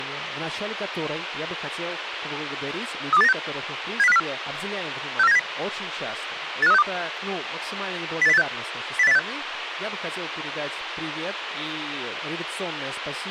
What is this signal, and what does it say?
Five-tone selective call (EEA), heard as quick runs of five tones, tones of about 40 ms, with radio hiss and speech in Russian. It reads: 32896 70504 64970 85362 08086 08086